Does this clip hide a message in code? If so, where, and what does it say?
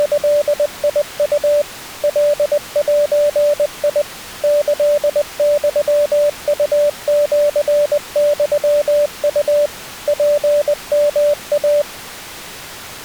Yes: Morse code (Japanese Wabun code) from 0.0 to 11.9 s, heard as a keyed tone, machine-sent, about 20 wpm, 590 Hz. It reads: … カゼ キユウシユウ ツヨイ